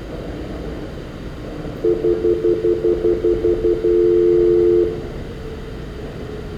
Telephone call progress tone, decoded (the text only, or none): stutter dial tone